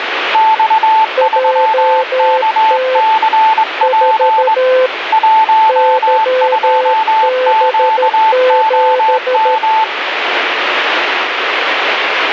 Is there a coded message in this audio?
Yes: Morse code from 0.3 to 9.9 s, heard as two keyed tones, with radio static. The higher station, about 20 wpm, 880 Hz: X3KCP 12QOM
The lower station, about 13 wpm, 510 Hz: JT 4 YB7